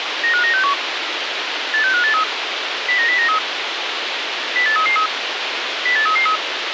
Five-tone selective call (CCIR), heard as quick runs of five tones, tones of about 100 ms, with radio hiss. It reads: 95961 86583 09093 08333 08333